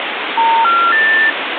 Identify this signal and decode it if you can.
Telephone call progress tone (North American plan), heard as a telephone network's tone, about 910, 1370, 1800 Hz, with phone line noise. Special information tone.